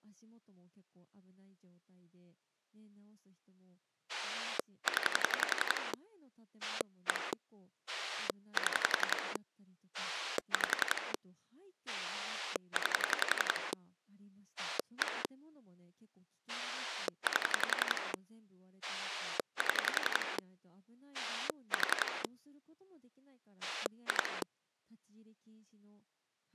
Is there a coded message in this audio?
Yes: pulse dialling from 4.1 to 24.4 s, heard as a rotary dial, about 11 pulses a second, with speech in Japanese. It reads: 0 1 7 5 9 1 8 7 4 2